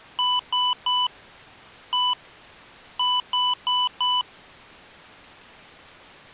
Beep code, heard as beeps from a small speaker, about 1000 Hz. 3-1-4. In Phoenix BIOS tables: interrupt mask register failure.